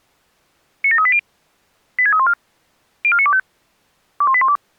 Five-tone selective call (ZVEI), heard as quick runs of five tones, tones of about 70 ms. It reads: 97380 86314 04925 21812